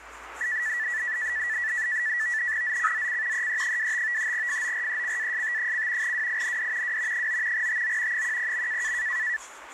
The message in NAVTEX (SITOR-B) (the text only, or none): ZCZC EE25 FORECAST: WIND W 9 TO 10.